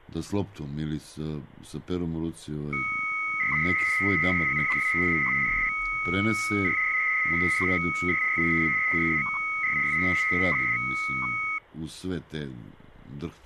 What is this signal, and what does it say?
300-baud modem data (Bell 103 tones), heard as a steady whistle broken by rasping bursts, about 300 baud, 200 Hz shift.